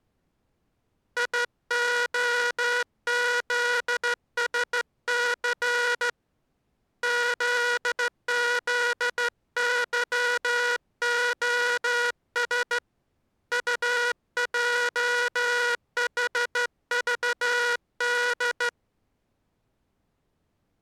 Morse code, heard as a buzzer, hand-sent with a straight key, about 14 wpm. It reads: IOZSC ZZYOS UJHVD